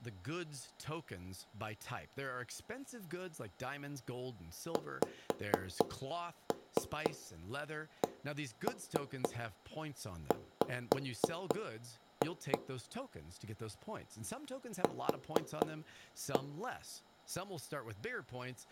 Tap code, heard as knocks on wood, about 4 knocks a second, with speech in English. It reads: XCW Q